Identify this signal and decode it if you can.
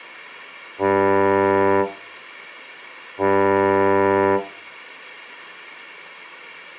Ship horn signal, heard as a ship's horn, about 100 Hz. 2 short. At sea: I am altering course to port.